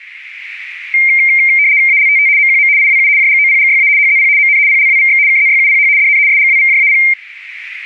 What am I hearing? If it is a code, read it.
RTTY (75 baud, 170 Hz shift), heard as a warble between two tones, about 2200 Hz centre. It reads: ALTT MQM IWU JGOPGYA HZP MN PLWVX KZYUPH DN SGWVJAP